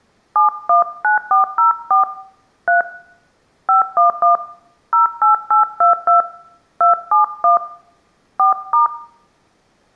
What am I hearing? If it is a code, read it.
DTMF, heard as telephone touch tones, dialled by hand, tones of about 130 ms. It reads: 719404 3 511 08822 271 4*